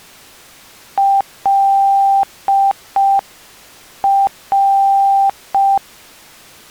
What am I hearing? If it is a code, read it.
Morse code (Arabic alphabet), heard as a keyed tone, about 5 wpm, 790 Hz. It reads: لر